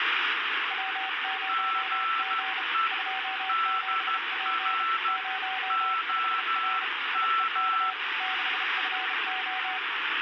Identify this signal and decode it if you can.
Morse code, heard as two keyed tones, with heavy radio static. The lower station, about 33 wpm, 760 Hz: W0G 27P 05R IEK 6FO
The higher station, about 12 wpm, 1330 Hz: GE DR OM